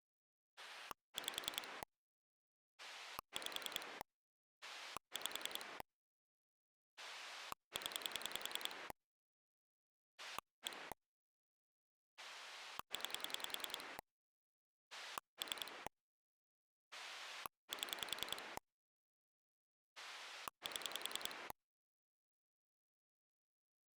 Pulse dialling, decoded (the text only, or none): 5 5 5 0 1 9 3 7 7